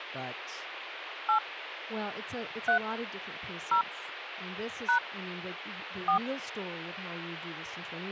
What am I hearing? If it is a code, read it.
DTMF, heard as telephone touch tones, dialled by hand, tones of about 100 ms, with radio hiss and speech in English. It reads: 8 3 0 # 4